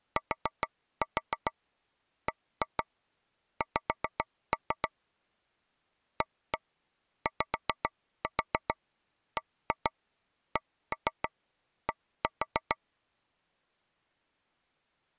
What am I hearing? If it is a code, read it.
Tap code, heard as taps on a table, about 7 knocks a second. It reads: TBX AYBCD